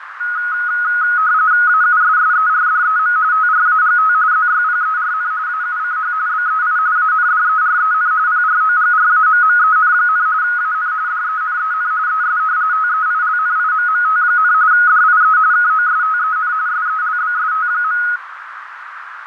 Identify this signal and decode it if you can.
RTTY (45.45 baud, 170 Hz shift), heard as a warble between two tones, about 1360 Hz centre, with radio static, fading and a narrow filter. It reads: AUSSERDEM TRAGT ZYPERN AUCH BEI ANDEREN PROGRAMMEN, AN DENEN ES TEILNIMMT, DIE KOSTEN SELBST.